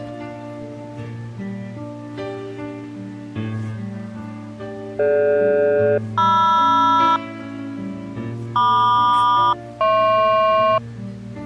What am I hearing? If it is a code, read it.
Aircraft SELCAL, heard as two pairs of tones. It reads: DG-MR MQ-HP